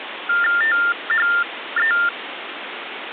TTY/TDD text telephone tones (45.45 baud Baudot), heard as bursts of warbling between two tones, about 400 Hz shift, 1600 Hz centre, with phone line noise. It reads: THE